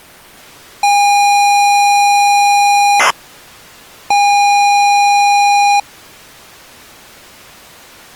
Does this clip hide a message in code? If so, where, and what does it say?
Yes: ZX Spectrum tape loading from 0.8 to 5.8 s, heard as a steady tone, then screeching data.